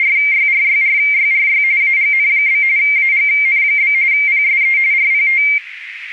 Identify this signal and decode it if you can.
RTTY (45.45 baud, 170 Hz shift), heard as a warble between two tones, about 2200 Hz centre, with radio static. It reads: … AGN? AGN? PSE RPT